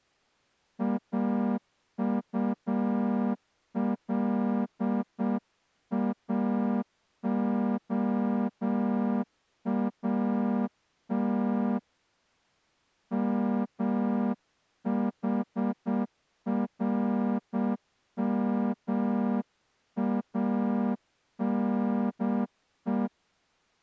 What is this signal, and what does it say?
Morse code (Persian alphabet), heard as a horn, hand-sent with a straight key, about 7 wpm. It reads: اطلاعات محرمانه